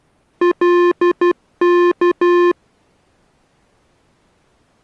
Morse code (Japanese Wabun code), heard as electronic beeps, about 12 wpm, 350 Hz. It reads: カワ